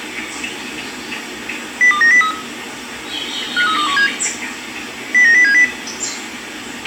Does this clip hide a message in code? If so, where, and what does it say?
Yes: five-tone selective call (CCIR) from 1.8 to 5.6 s, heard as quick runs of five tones, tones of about 100 ms, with a squelch burst at the end and the noise of a park. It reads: 02903 53217 09070